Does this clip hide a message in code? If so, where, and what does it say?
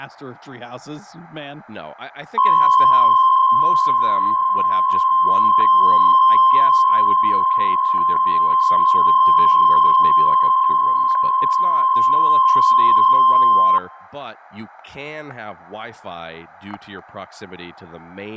Yes: PSK63 (62.5 baud) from 2.4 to 13.8 s, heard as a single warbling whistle, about 1050 Hz, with static crashes and speech in English.